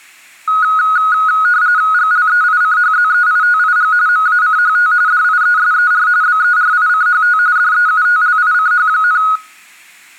RTTY (45.45 baud, 170 Hz shift), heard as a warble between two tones, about 1360 Hz centre. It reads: GLEICHZEITIG MACHT DIESER BERICHT DEUTLICH,